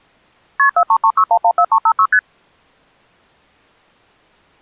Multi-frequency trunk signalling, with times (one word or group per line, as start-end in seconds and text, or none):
0.6-0.7 KP
0.8-2.1 4336114356
2.1-2.2 ST